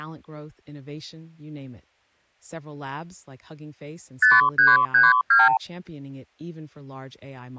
Multi-frequency trunk signalling (R2, with the far end's replies), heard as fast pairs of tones, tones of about 180 ms, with speech in English. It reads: 5332